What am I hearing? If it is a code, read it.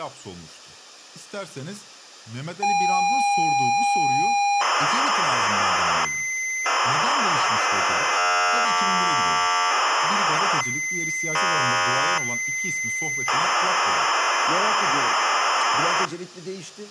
ZX Spectrum tape loading, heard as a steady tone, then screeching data, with speech in Turkish.